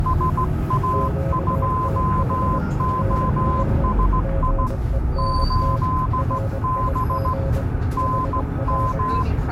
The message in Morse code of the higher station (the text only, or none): SA2OSI 8B NM